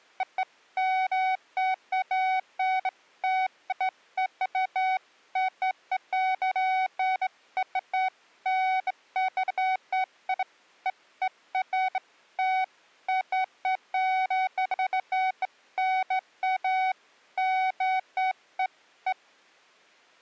Beeps of irregular length. There is no code.